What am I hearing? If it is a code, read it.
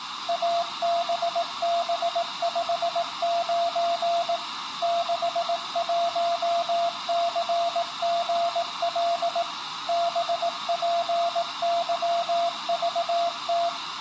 Morse code, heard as a keyed tone, machine-sent, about 18 wpm, 680 Hz. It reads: ABB59 61CGL BPYVT